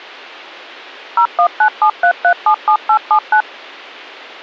DTMF, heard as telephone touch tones, dialled by machine, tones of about 80 ms. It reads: 01973377879